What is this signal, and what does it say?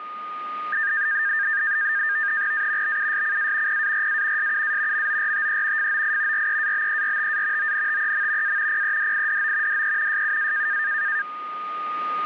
NAVTEX (SITOR-B), 100 baud, 170 Hz shift, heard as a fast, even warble, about 1700 Hz centre, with a steady whistle near 1230 Hz. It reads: A BUSCA PARA SUA MORTE FOI REABERTA ONTEM A PEDIDO DE SUA